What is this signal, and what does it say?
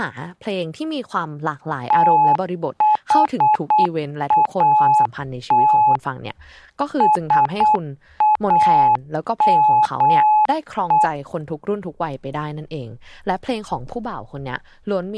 Morse code, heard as a keyed tone, machine-sent, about 8 wpm, 850 Hz, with speech in English. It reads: THAT SAME